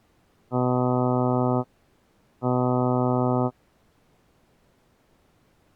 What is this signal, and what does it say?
Ship horn signal, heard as a ship's horn, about 120 Hz. 2 short. At sea: I am altering course to port.